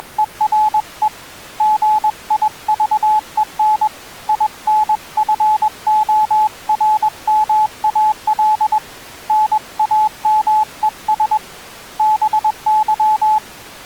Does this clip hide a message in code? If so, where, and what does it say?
Yes: Morse code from 0.0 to 13.4 s, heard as a keyed tone, hand-sent with a paddle, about 21 wpm, 860 Hz. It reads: … GIVEN INFORMAL NAMES BY